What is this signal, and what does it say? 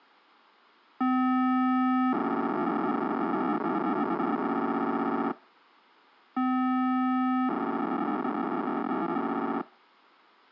POCSAG pager data (512 baud), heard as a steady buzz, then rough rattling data.